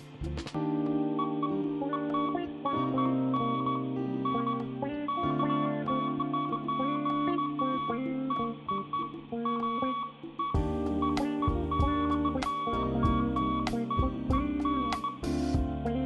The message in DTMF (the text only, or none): none